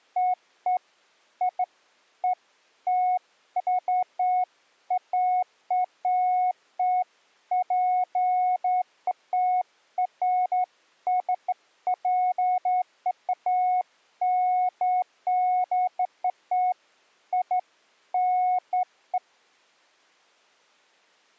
Beeps of irregular length. There is no code.